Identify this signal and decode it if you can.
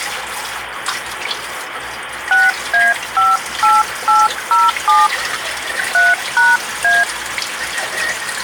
DTMF, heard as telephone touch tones, dialled by hand, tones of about 190 ms, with phone line noise and kitchen noise. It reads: 6A58807 3#A